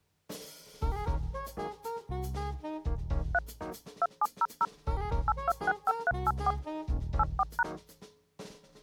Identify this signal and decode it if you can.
DTMF, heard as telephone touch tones, dialled by machine, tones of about 40 ms. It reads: 3 2700 8265384 84#